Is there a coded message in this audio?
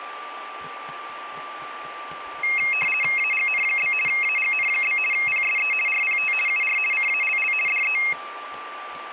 Yes: RTTY (50 baud, 450 Hz shift) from 2.4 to 8.1 s, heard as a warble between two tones, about 2350 Hz centre, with a steady whistle near 1180 Hz and kitchen noise. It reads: AGN? AGN? PSE RPT UR CALL DE